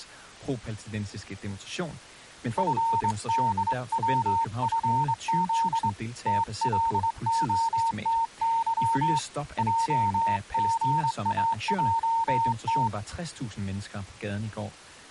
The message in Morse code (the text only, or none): FDWFZ TLOTY JGAJT